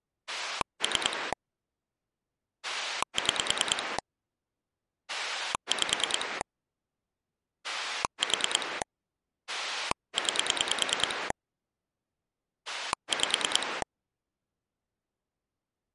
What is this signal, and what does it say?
Pulse dialling, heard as a rotary dial, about 9 pulses a second. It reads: 3 6 5 4 9 5